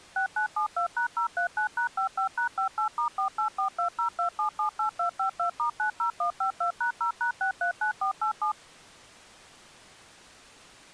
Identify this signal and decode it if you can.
DTMF, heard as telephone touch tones, dialled by machine, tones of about 100 ms. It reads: 6972#039#55#58*484202778252*90152#0#639487